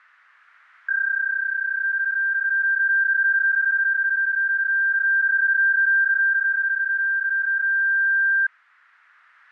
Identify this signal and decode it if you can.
PSK31 (31.25 baud), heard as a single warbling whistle, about 1600 Hz.